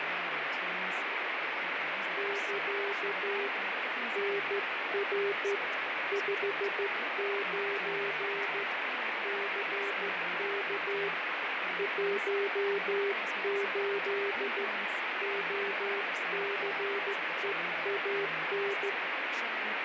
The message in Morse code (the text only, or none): <KA> NR 59 CK 18 OCEAN